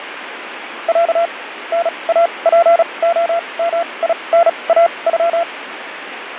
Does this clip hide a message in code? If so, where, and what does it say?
Yes: Morse code (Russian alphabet) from 0.8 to 5.5 s, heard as a keyed tone, machine-sent, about 36 wpm, spaced as for 26 wpm, 680 Hz, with radio static. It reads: Я НАПОМИНАЮ